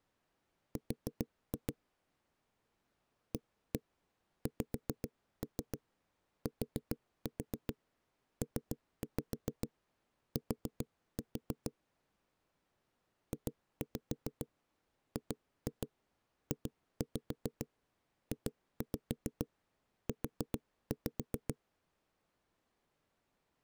Tap code, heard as knocks on a wall, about 7 knocks a second. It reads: R AXTPT JGJJU